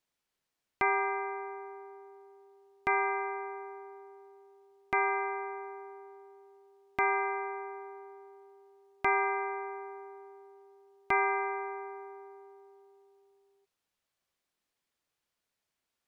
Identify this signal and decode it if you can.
Clock strike, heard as a bell. 6. Six o'clock.